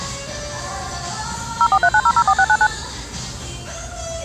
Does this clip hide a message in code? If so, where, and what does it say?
Yes: DTMF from 1.6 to 2.7 s, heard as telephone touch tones, dialled by machine, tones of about 60 ms, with the noise of a restaurant. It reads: 0439004699